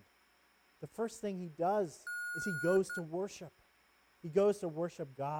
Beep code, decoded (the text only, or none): 1 long, 1 short